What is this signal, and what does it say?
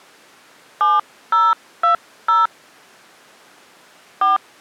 DTMF, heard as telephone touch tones, dialled by hand, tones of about 150 ms. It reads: 7020 4